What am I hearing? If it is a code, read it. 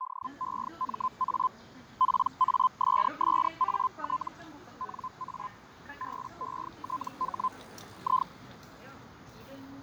Hellschreiber (Feld-Hell, 122.5 baud), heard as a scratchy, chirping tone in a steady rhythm, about 1030 Hz, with fading and the noise of a park. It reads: DEMA PASSAT NA BETH I